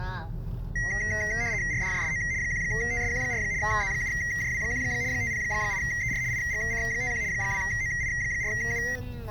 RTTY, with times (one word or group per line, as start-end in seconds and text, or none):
1.7-2.2 RDJSO
2.4-3.4 1TSQ4
3.6-4.8 Z7JW1
5.1-6.2 508ER
6.3-7.2 IGC51
7.3-8.8 2OI4U